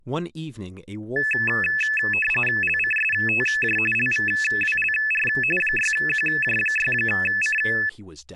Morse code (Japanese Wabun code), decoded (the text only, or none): none